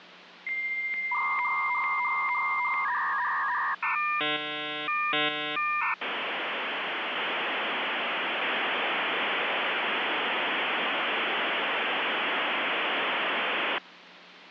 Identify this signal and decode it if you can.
Dial-up modem handshake (V.34 or later), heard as a whistle, warbles, then hiss, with phone line noise.